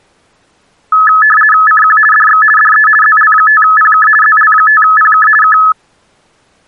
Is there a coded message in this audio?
Yes: RTTY (50 baud, 450 Hz shift) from 0.9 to 5.7 s, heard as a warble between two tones, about 1500 Hz centre. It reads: CQ DX DE ZL5PK ZL5PK K